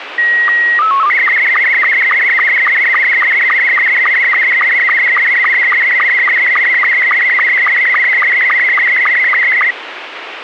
SSTV (slow-scan television), Scottie S2, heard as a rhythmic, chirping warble, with radio hiss.